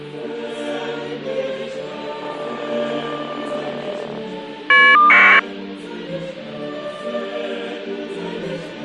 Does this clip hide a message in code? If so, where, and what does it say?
Yes: caller ID data burst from 2.2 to 5.4 s, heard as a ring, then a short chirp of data, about 1200 baud.